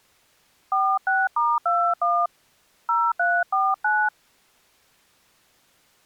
DTMF, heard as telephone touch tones, dialled by hand, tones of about 240 ms. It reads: 46*21 0349